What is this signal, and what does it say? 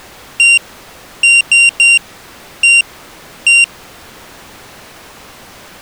Beep code, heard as a piezo beeper, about 2750 Hz. 1-3-1-1. In Phoenix BIOS tables: memory refresh test failure.